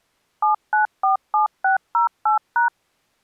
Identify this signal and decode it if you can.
DTMF, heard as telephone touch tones, dialled by machine, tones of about 120 ms. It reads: 7947608#